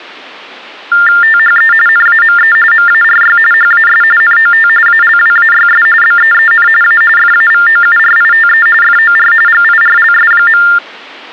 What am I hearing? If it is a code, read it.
TTY/TDD text telephone tones (45.45 baud Baudot), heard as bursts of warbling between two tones, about 400 Hz shift, 1600 Hz centre. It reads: THE NAME MARY HAS NOT ALWAYS BEEN A FAVOURITE FOR GIRLS.